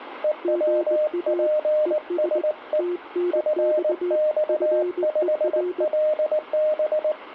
Morse code, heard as two keyed tones, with radio static. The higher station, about 19 wpm, 610 Hz: EWPSE FX5LB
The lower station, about 20 wpm, 350 Hz: GA ES TNX FER